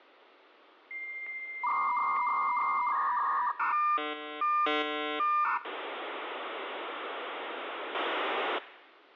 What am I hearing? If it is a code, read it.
Dial-up modem handshake (V.34 or later), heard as a whistle, warbles, then hiss.